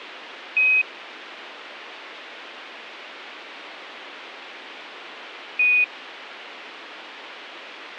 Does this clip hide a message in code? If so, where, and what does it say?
Yes: Quindar tones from 0.6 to 5.8 s, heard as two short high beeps, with a squelch burst at the end.